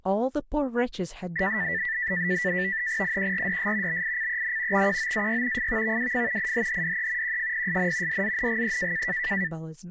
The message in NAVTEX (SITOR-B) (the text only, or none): IQRDS BICEN XQOAY FVVWF IHHDE QFPSN DZNGE